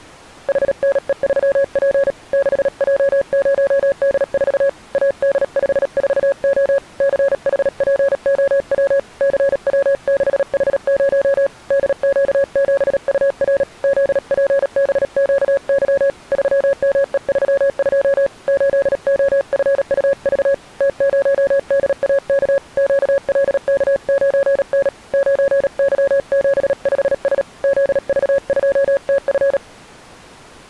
Morse code, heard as a keyed tone, hand-sent with a paddle, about 37 wpm, 550 Hz. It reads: HNE3P 6J0D4 AD54O CHPOW CW6H0 DQ7UR ZPBQY 3ME32 8OFUV T0DAK QLK9N 9Y75S ZV2TF